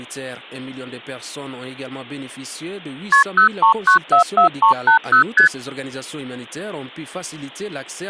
Multi-frequency trunk signalling (R1, as on North American trunks), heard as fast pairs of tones, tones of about 110 ms. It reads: KP 03944380 ST